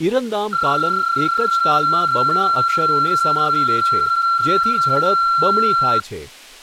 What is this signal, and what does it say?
PSK31 (31.25 baud), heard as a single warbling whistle, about 1360 Hz, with speech in Gujarati.